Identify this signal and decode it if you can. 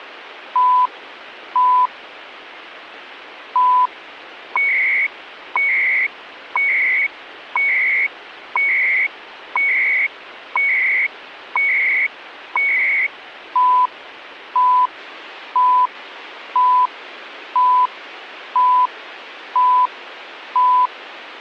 Radio time signal (CHU, Canada), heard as beeps and data bursts, one a second, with radio static.